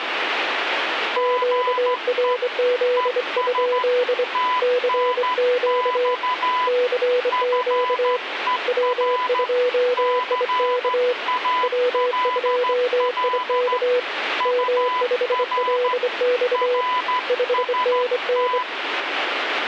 Morse code, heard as two keyed tones, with radio static. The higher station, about 13 wpm, 1000 Hz: GE ES TNX FER CALL UR RST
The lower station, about 25 wpm, 490 Hz: QRZ? CQ CQ W2IK W2IK M5LX 5NN